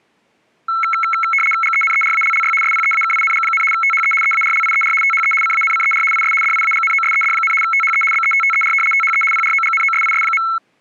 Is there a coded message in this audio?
Yes: RTTY (75 baud, 850 Hz shift) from 0.7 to 10.6 s, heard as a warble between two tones, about 1750 Hz centre. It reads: GENERALLY SPEAKING, THE EARLIER THE CANCER IS DIAGNOSED, THE BETTER THE PROGNOSIS.